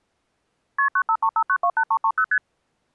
Multi-frequency trunk signalling (R1, as on North American trunks), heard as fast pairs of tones, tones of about 70 ms. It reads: KP 9535928330 ST